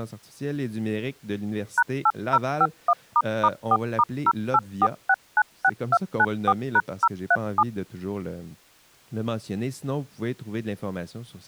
DTMF, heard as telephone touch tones, dialled by machine, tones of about 50 ms, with speech in French. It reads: #8051**4*084696294#037